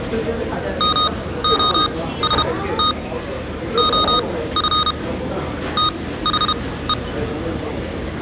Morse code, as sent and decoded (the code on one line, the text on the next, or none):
-- --- ... - / --- ..-. / - .... .
MOST OF THE